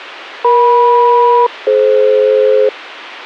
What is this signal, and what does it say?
Aircraft SELCAL, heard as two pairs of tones. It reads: EM-DF